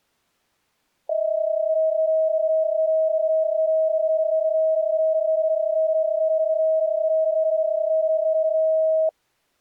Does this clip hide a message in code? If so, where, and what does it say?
Yes: PSK31 (31.25 baud) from 1.1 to 9.1 s, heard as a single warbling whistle, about 640 Hz.